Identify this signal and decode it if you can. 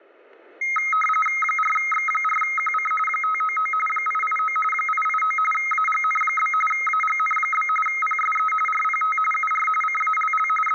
RTTY (45.45 baud, 850 Hz shift), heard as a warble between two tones, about 1700 Hz centre, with static crashes. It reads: 4X4QC 599 889 889 AGN? AGN? PSE RPT UR CALL …